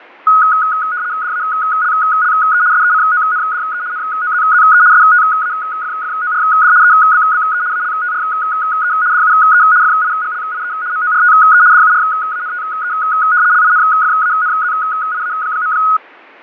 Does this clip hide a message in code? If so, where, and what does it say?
Yes: RTTY (75 baud, 170 Hz shift) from 0.3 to 16.0 s, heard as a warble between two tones, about 1360 Hz centre, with fading. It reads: DALLE SECONDE NOZZE STAFFORD EBBE ALTRE DUE FIGLIE MORTE DURANTE LINFANZIA.